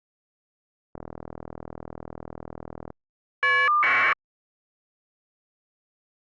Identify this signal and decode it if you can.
Caller ID data burst, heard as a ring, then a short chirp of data, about 1200 baud.